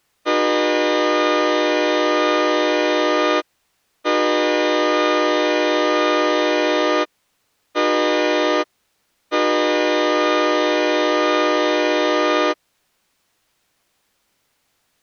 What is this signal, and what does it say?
Train horn signal, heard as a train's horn. 2 long, 1 short, 1 long. On North American railways: approaching a public crossing.